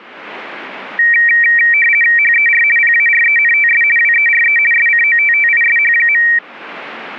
RTTY (50 baud, 450 Hz shift), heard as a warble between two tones, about 2100 Hz centre. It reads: HER PARENTS WERE SCOTTISH.